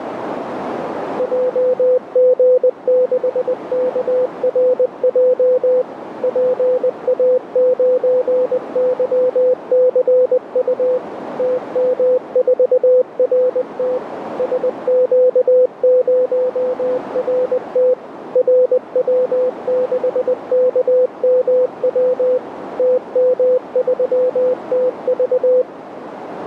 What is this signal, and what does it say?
Morse code, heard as a keyed tone, machine-sent, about 20 wpm, 500 Hz, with radio static and a narrow filter. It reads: JG6KRJ PA9YCU TM4RT SQ0RT RW6KMW TM3TV